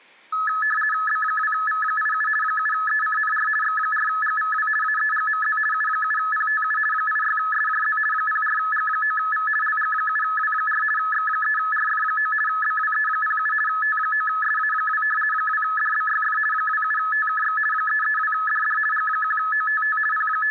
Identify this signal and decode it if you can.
RTTY (50 baud, 450 Hz shift), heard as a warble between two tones, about 1500 Hz centre, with room echo. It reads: B2V87 7ECNR X4GVW AEGMZ U7PTU 86SJZ 04G9V LG7W4 X3RF9 BWE07 T9SA2 2DBYF 27TKX 332DD G1OTT …